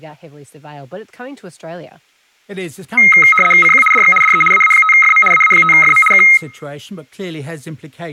RTTY (75 baud, 850 Hz shift), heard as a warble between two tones, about 1700 Hz centre, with speech in English. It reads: CQ DX DE AA5FM AA5FM K